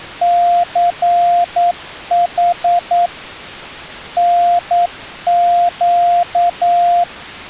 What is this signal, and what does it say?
Morse code, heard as a keyed tone, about 9 wpm, 700 Hz. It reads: CH NQ